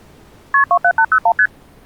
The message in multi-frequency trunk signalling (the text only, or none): KP 27801 ST